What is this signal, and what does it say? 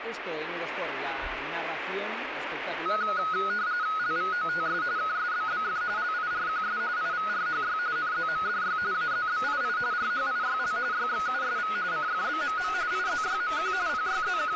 RTTY (45.45 baud, 170 Hz shift), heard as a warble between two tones, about 1360 Hz centre, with radio static. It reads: LVOTS KSBBF LIRQS IVRHY NZMDY AZBII RHIYL YXUSV CFBMM IZYMQ …